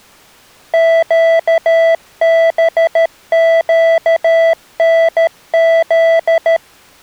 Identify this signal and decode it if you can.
Morse code, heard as electronic beeps, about 13 wpm, 660 Hz. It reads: QBQNZ